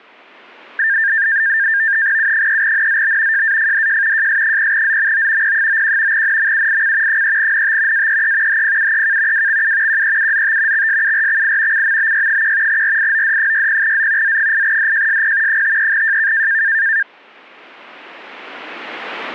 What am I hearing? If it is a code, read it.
NAVTEX (SITOR-B), 100 baud, 170 Hz shift, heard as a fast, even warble, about 1700 Hz centre. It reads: U3NZB JAFDJ JS0ZMO P91 NMUIC 3NT AEE HPUEK WXU QEUZT XSURXI CMBY1 RIOD60Z Z8DJSP 53JK